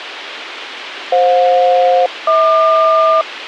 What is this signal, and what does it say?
Aircraft SELCAL, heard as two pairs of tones, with radio hiss and a squelch burst at the end. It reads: FJ-HQ